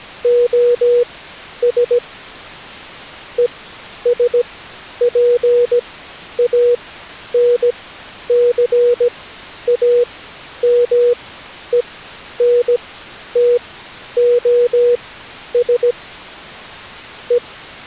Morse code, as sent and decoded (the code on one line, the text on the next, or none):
--- ... / . ... .--. .- -. -.-. .- -- . -. - --- ... / .
OS ESPANCAMENTOS E